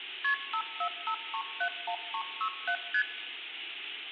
Multi-frequency trunk signalling (R1, as on North American trunks), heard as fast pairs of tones, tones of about 80 ms, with phone line noise and room echo. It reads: KP 545371367 ST